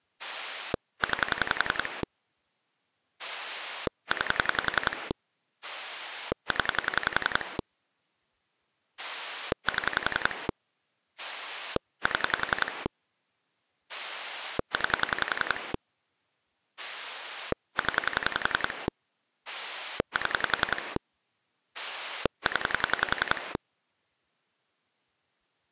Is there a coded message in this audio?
Yes: pulse dialling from 0.2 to 23.6 s, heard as a rotary dial, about 11 pulses a second. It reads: 9 9 0 7 7 9 0 7 0